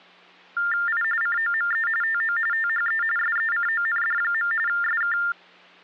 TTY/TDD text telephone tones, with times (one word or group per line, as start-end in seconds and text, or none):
0.9-1.0 I
1.2-1.9 COME
2.0-2.4 TO
2.5-3.0 THE
3.2-4.5 SECOND.
4.7-5.2 SK